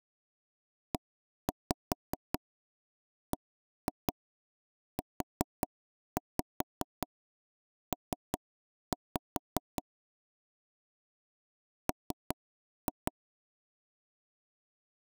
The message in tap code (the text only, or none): EBUP M